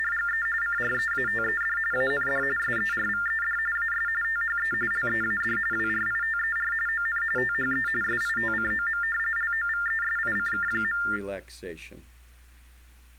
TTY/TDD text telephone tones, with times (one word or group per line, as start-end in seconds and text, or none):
0.0-0.5 …
0.6-1.8 CREATED
1.9-2.4 AND
2.6-3.6 SERVED
3.8-4.1 AS
4.2-4.7 THE
4.9-5.6 LEAD
5.7-6.7 WRITER
6.9-7.2 ON
7.4-7.9 THE
8.0-9.0 SITCOM
9.4-11.0 LOVESICK.